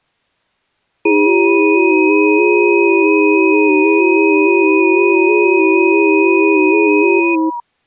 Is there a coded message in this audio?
Yes: FT8 (several signals at once) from 1.1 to 7.6 s, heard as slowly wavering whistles, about 6.25 baud.